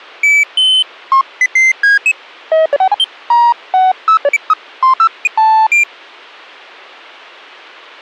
Electronic bleeps of random pitch and length. There is no code.